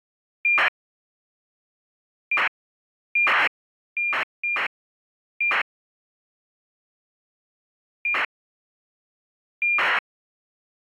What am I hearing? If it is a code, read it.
ACARS aircraft data, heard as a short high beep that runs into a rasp, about 2400 baud.